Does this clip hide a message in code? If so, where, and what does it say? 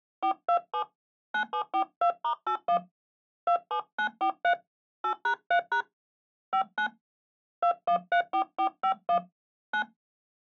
Yes: DTMF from 0.2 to 9.8 s, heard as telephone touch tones, dialled by hand, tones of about 90 ms. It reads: 427 9742*81 27943 8#3# 59 2134451 9